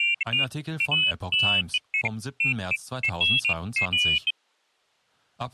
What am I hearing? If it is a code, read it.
Pairs of high tones at irregular times, with speech in German. There is no code.